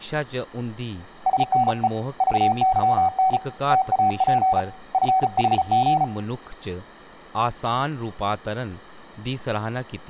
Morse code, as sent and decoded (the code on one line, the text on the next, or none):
... -. . / ...- -.-- -. / - .- .--. / ..-. .... --.
SNE VYN TAP FHG